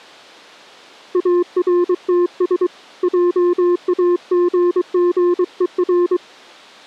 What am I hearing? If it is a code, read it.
Morse code, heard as a keyed tone, hand-sent with a paddle, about 23 wpm, 350 Hz. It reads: ARTS JAGGER